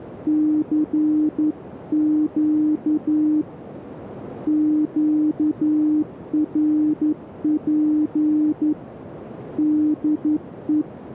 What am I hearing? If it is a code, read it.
Morse code, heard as a keyed tone, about 11 wpm, 300 Hz, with radio static and a narrow filter. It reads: CQ QRP DE